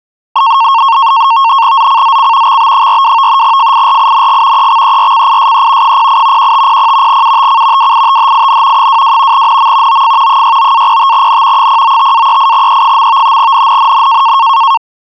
NAVTEX (SITOR-B), 100 baud, 170 Hz shift, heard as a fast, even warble, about 1000 Hz centre. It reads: ZCZC XB42 FIRING EXERCISE 08 1500 UTC WITHIN 22 NM OF 69-05N 095-38E. NNNN